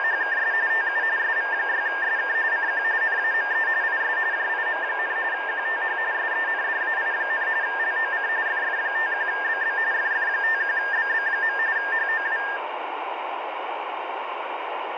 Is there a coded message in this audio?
Yes: RTTY (45.45 baud, 170 Hz shift) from 0.0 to 12.6 s, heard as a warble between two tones, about 1700 Hz centre, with radio static. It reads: … TU SV6SK CQ NAME IS JIM, QTH SENDAI, LOC FF51BB FF51BB. HOW